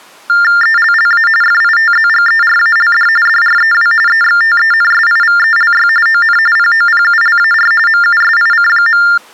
TTY/TDD text telephone tones (45.45 baud Baudot), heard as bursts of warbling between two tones, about 400 Hz shift, 1600 Hz centre. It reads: ELLA FITZGERALD DREW EXTENSIVELY ON POPULAR MUSIC.